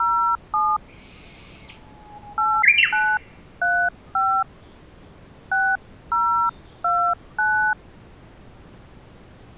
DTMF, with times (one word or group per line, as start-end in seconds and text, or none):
0.0-0.8 07
2.4-4.4 8935
5.5-7.7 6029